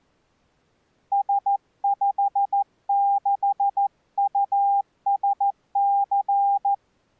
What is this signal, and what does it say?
Morse code, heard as a keyed tone, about 14 wpm, 800 Hz. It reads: S56USC